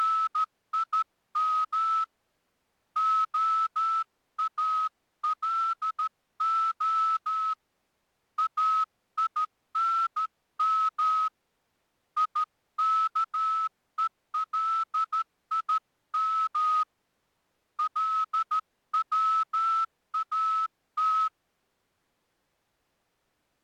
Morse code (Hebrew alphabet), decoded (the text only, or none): … האלה אינם יכולים לצאת